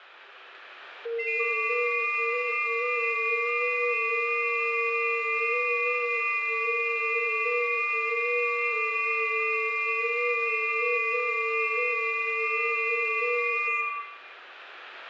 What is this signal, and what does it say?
FT8 (several signals at once), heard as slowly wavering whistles, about 6.25 baud, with room echo.